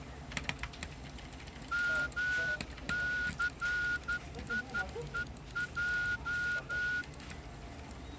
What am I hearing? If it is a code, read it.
Morse code (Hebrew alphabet), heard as a whistle, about 12 wpm, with the noise of a crowd indoors. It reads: מסיוע